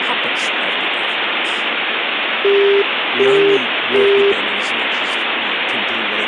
Telephone call progress tone (as in the UK, Australia and similar networks), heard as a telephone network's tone, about 400 Hz, 0.375 s on and 0.375 s off, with phone line noise and speech in English. Busy tone.